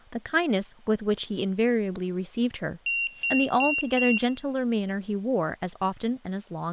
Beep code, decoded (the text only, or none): 4 short